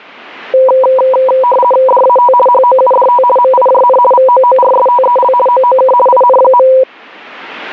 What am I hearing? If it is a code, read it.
RTTY (50 baud, 450 Hz shift), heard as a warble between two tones, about 750 Hz centre. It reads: DAT HOUDT MIJN VOORSTEL OOK IN.